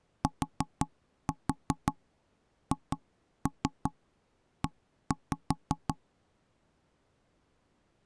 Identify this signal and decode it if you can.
Tap code, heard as knocks on wood, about 5 knocks a second. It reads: THE